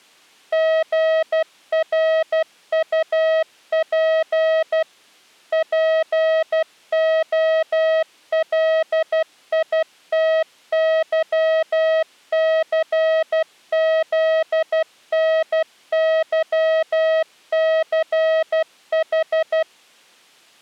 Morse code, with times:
0.5-4.8 GRUP
5.5-19.6 POLITYCZNYCH

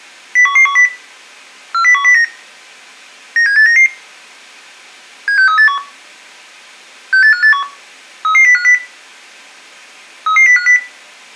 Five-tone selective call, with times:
0.4-0.9 01110
1.7-2.2 40109
3.4-3.9 97899
5.3-5.8 76381
7.1-7.6 68581
8.2-8.7 33050
10.3-10.8 33050

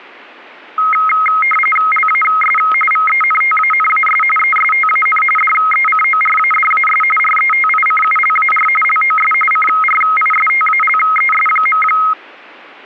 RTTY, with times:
1.9-2.6 LAS
2.9-4.2 VENTANAS
4.4-5.2 ESTAN
5.4-7.0 DECORADAS
7.2-8.7 RETICULAR
8.8-9.3 LOS
9.5-11.8 CRISTALES.

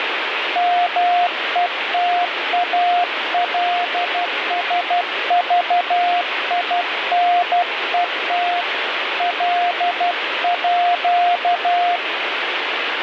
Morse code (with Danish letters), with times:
0.6-8.6 METALSVINET
9.2-12.0 LÅ

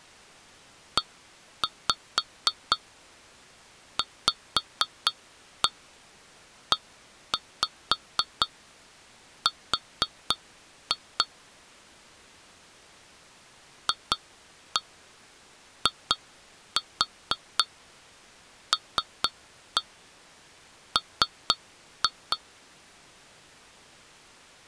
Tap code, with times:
1.0-11.2 EVER
13.9-22.4 FILM

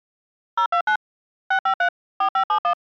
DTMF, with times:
0.6-1.0 029
1.5-1.9 653
2.2-2.7 4571

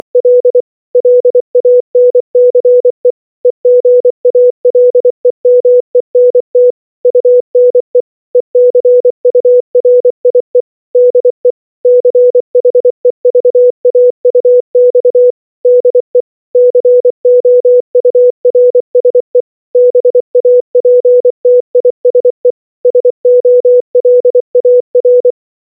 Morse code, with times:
0.0-0.6 …
1.0-3.1 LANCE
3.5-6.7 EGALEMENT
7.1-8.0 UNE
8.4-10.6 ECURIE
11.0-11.5 DE
11.9-15.3 CHEVAUX
15.7-16.2 DE
16.6-19.4 COURSE
19.8-22.5 BAPTISE
22.9-25.3 SOLAR

